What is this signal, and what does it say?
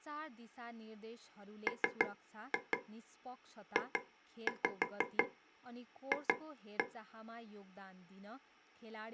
Tap code, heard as taps on a table, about 6 knocks a second, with speech in Nepali. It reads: MJF